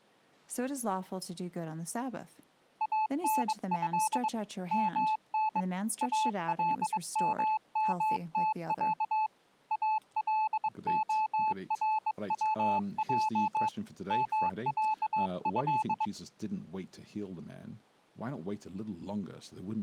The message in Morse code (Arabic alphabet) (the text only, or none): انه من الممتع الخروج معه